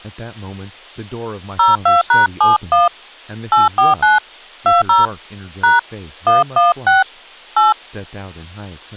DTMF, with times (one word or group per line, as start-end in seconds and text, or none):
1.6-2.9 02#71
3.5-4.2 849
4.7-5.1 20
5.6-5.8 #
6.3-7.0 116
7.6-7.7 8